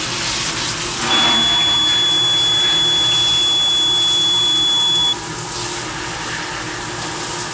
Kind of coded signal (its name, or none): none